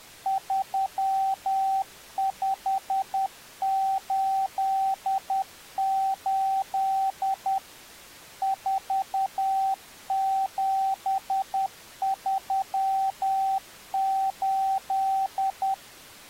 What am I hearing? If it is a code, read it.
Morse code, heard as a keyed tone, machine-sent, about 10 wpm, 770 Hz. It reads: 3588 4738